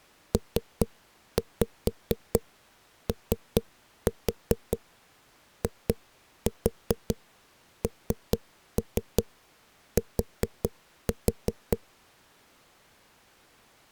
Tap code, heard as knocks on a wall, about 4 knocks a second. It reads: POINT